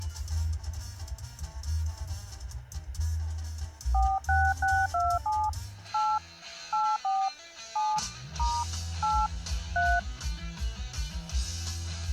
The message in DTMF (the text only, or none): 46627 8 84 7 * 8 3